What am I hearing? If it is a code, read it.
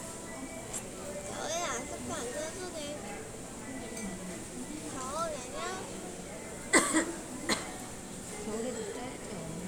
The noise of a restaurant. There is no code.